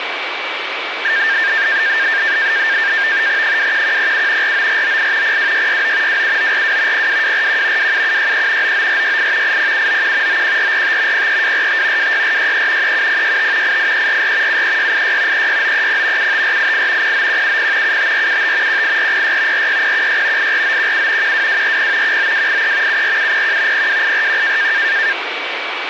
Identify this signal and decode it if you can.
NAVTEX (SITOR-B), 100 baud, 170 Hz shift, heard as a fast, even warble, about 1700 Hz centre, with radio static and a steady whistle near 2290 Hz. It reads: 21107 49498 02669 27942 02241 27763 99468 80791 91445 03245 26463 37065 88344 73686 36930 75488 09170 75475 18406 46016 84917 12240 19283 74701 02841